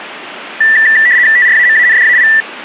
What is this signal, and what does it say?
RTTY (75 baud, 170 Hz shift), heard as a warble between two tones, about 1850 Hz centre. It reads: TRAMANDAI